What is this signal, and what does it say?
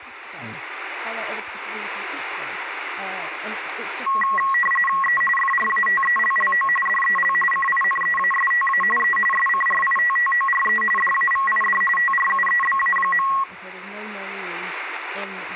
RTTY (45.45 baud, 850 Hz shift), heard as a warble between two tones, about 1500 Hz centre, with radio static, static crashes and speech in English. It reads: E FRATELLO DEL CINEASTA E SCRITTORE DAVID TRUEBA.